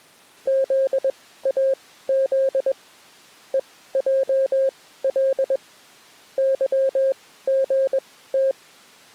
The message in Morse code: ZAZ EJL YGT

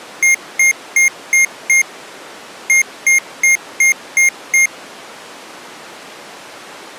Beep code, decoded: 5-6

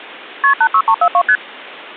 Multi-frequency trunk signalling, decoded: KP 86342 ST

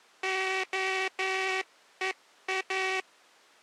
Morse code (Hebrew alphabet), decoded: הוא

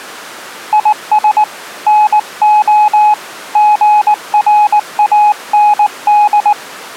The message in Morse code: IS NO GRAND

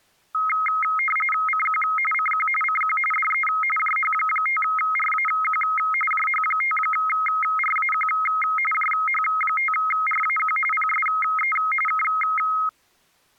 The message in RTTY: CQ CQ CQ DE JH5RAQ JH5RAQ JH5RAQ PSE K

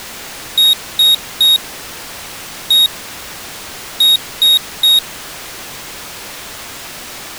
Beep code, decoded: 3-1-3

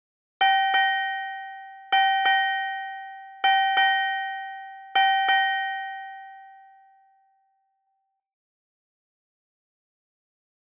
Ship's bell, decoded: 8

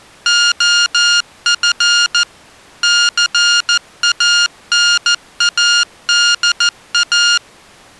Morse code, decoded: OF CANADA

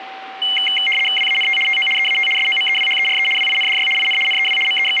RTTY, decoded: WANT TO EAT SOMEWHERE WINDY IN NEW …

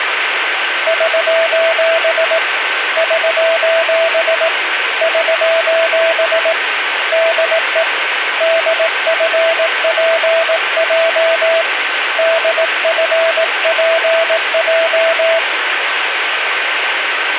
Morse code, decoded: <SOS> <SOS> <SOS> DE DFPJ DFPJ

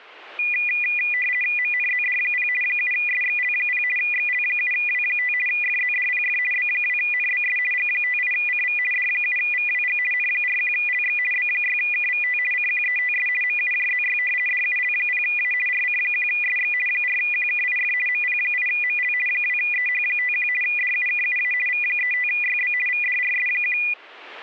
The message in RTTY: MNZD0 7SXL0 XL7W5 FZDPF B2NBS G58CV D7VWG N41LX B6KVT CQETS MUJZY DUL0A RC1SX 4QKIF MP8ML 2EH51 DUKUA V35YB VDRS1

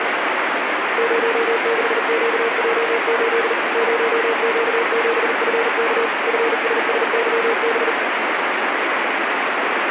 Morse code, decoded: 06QJ8 0Q7FK FSSYB

